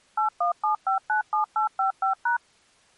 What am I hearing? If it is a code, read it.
DTMF, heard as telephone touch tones, dialled by machine, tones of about 120 ms. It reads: 817597855#